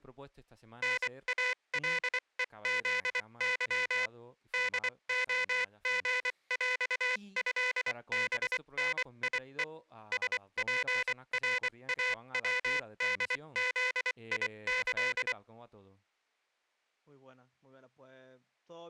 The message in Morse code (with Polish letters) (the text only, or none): NALEZY DOGŁĘBNIE SPRAWDZIĆ